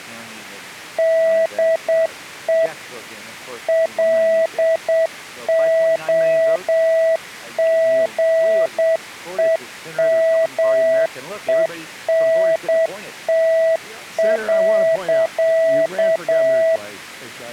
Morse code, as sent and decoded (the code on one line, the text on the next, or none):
-.. . / .-.. --- --. . -- . -. - .-.-.-
DE LOGEMENT.